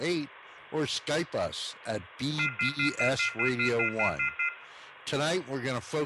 Telephone call progress tone (North American plan), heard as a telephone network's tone, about 1400, 2050, 2450, 2600 Hz, 0.1 s on and 0.1 s off, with room echo. Off-hook warning tone.